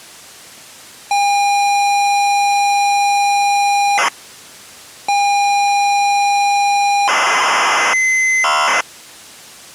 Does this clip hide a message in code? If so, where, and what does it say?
Yes: ZX Spectrum tape loading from 1.1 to 8.8 s, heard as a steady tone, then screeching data.